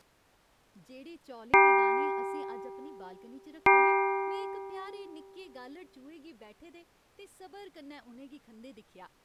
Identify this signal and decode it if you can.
Clock strike, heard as a bell, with speech in Dogri. 2. Two o'clock.